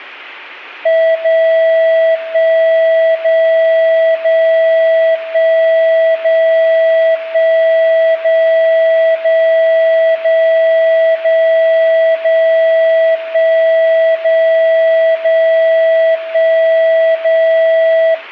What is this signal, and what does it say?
Radio time signal (DCF77), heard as a tone whose level steps once a second, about 650 Hz. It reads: 0 1 0 0 1 0 1 0 0 0 0 0 1 0 0 1 0